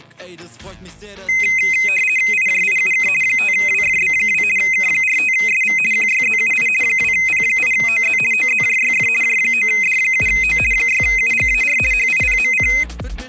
RTTY (50 baud, 450 Hz shift), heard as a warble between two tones, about 2300 Hz centre. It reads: IJIUK 5WFB2 K45SV QYZUI 2P8OZ OZJYF J9D7O 6UGAR HIPMC